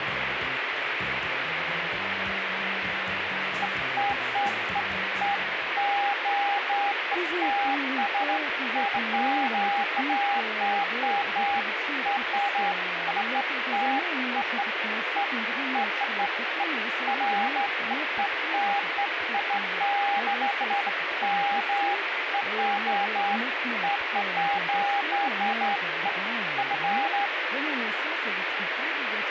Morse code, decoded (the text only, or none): none